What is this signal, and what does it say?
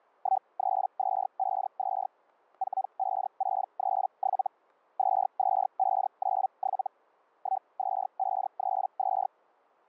Hellschreiber (Feld-Hell, 122.5 baud), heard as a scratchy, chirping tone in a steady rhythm, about 770 Hz, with static crashes. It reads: 13252 45637 22597 12532